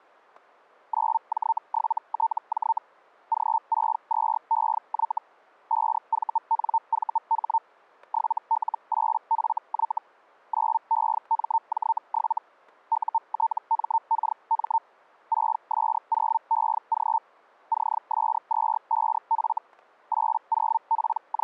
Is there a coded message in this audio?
Yes: Hellschreiber (Feld-Hell, 122.5 baud) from 0.9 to 21.4 s, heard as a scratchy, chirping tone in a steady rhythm, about 900 Hz, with static crashes. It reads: 9J7TJ G62EY 5VNVH 7L8FY 9EMJ7 UTMKM 6S0EG CS25F …